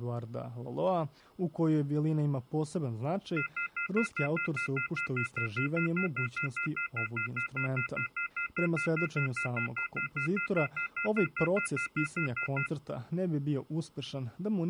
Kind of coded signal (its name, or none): telephone call progress tone